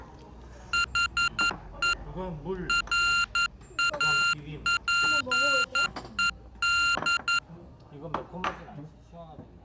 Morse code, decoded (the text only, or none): HE RAPED